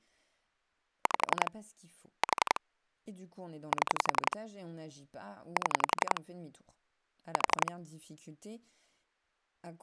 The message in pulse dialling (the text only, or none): 5 4 7 7 4